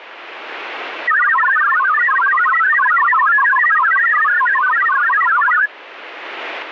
Multi-tone FSK (Olivia or MFSK type), about 1000 Hz wide, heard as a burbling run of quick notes, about 62.5 baud, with radio static.